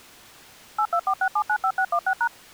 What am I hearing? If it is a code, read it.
DTMF, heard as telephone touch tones, dialled by machine, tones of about 70 ms. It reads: 8246795616#